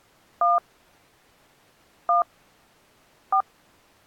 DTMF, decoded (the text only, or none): 1 1 4